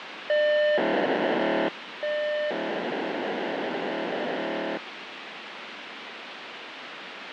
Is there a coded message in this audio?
Yes: POCSAG pager data (1200 baud) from 0.3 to 4.8 s, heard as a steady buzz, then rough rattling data, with radio hiss.